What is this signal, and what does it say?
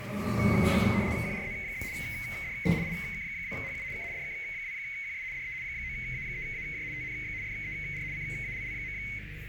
RTTY (75 baud, 170 Hz shift), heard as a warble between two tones, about 2150 Hz centre, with radio static, a narrow filter and the noise inside a lift. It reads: QRZ? DE IK2HU K DK2QS DE 9A3AJ TNX FER CALL.